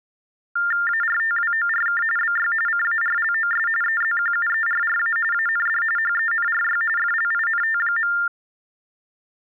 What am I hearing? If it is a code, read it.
TTY/TDD text telephone tones (45.45 baud Baudot), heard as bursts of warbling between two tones, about 400 Hz shift, 1600 Hz centre. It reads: ARTWORK BY CARLOS EZQUERRA AND HENRY FLINT.